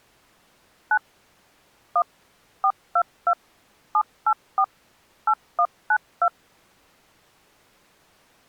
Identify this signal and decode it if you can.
DTMF, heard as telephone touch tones, dialled by machine, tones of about 70 ms. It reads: 9 1 422 784 8192